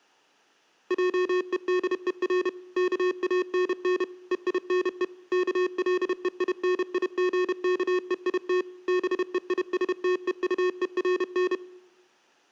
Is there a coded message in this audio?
Yes: Morse code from 0.8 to 11.6 s, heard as electronic beeps, machine-sent, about 31 wpm, 360 Hz. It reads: JEDER KANN EINE KLEINIGKEIT BEISTEUERN